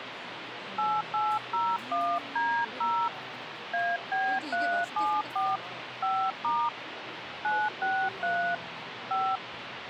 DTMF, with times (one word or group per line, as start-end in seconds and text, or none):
0.8-3.1 8801D0
3.7-5.6 AB374
6.0-6.7 5*
7.4-8.6 963
9.1-9.4 5